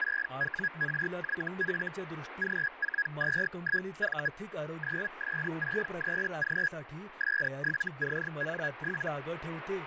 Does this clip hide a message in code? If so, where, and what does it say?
Yes: Hellschreiber (Feld-Hell, 122.5 baud) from 0.0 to 9.1 s, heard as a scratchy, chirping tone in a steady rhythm, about 1650 Hz, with radio static and speech in Marathi. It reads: 6WRYF G421V 9S63G S7CN7